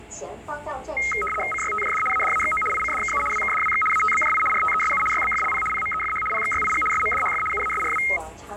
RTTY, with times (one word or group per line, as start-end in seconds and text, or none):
1.5-2.0 CYTJD
2.1-2.6 ADAXO
2.7-3.2 ICDKU
3.3-3.8 WKDWX
3.9-4.4 ATBJI
4.5-5.0 RTESU
5.1-5.6 YBFLP
5.7-6.2 PMEFH
6.3-6.8 PXYIG
6.9-7.4 SMDHF
7.5-8.0 UASRW